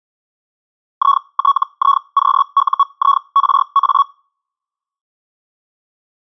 Hellschreiber (Feld-Hell, 122.5 baud), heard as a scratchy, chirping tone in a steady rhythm, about 1120 Hz. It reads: ITIQUIRA